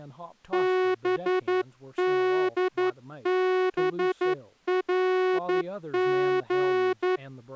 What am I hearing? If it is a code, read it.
Morse code, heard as a horn, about 11 wpm, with speech in English. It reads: BDBRG